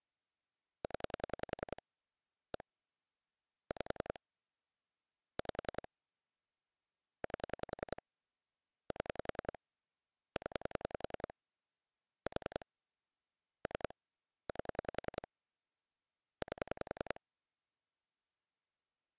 Pulse dialling, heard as clicks on a phone line, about 10 pulses a second. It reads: 0 1 5 5 8 7 0 4 3 8 8